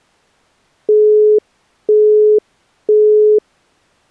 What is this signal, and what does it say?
Telephone call progress tone (single-tone plan, as in Europe, Japan and elsewhere), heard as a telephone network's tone, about 420 Hz, 0.5 s on and 0.5 s off. Busy tone.